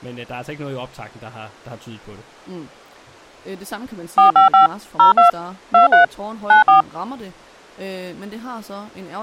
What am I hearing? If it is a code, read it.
DTMF, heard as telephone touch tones, dialled by machine, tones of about 130 ms, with speech in Danish. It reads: 455 02 23 94